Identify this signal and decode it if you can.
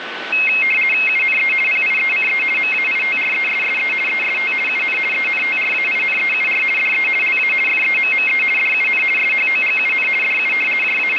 RTTY (50 baud, 450 Hz shift), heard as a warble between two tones, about 2350 Hz centre, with radio static and a steady whistle near 1510 Hz. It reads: UNE PIECE MAITRESSE EST UN ENTRAINEUR DE LA FEMME DUN SHOGUN DU …